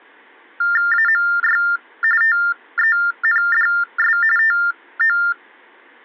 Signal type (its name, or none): TTY/TDD text telephone tones